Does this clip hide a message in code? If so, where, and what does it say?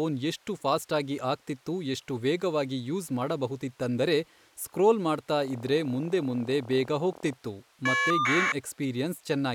Yes: caller ID data burst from 5.4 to 8.5 s, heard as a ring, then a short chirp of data, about 1200 baud, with speech in Kannada.